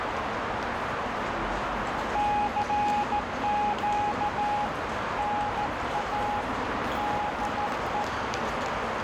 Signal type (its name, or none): Morse code